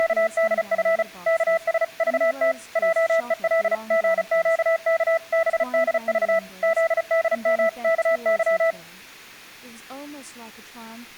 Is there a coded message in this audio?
Yes: Morse code (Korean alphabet) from 0.0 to 8.8 s, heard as a keyed tone, machine-sent, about 35 wpm, 660 Hz, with speech in English. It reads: … 여러 학생들 틈에